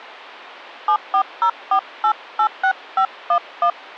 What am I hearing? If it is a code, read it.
DTMF, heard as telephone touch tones, dialled by hand, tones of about 80 ms. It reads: 7404886511